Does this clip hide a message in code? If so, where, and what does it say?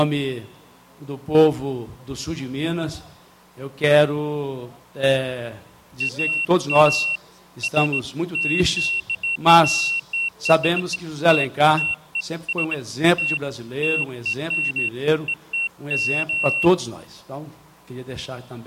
No, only beeps of irregular length.